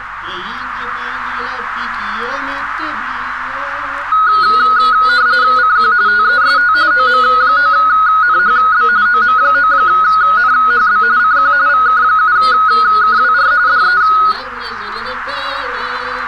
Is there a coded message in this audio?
Yes: RTTY (45.45 baud, 170 Hz shift) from 4.1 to 14.3 s, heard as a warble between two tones, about 1360 Hz centre, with radio static and a narrow filter. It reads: CQ TEST OM9NHB OM9NHB CQ VK7KWR DE